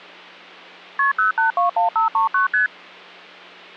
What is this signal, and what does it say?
Multi-frequency trunk signalling (R1, as on North American trunks), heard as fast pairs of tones, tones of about 130 ms, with hum. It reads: KP 0821539 ST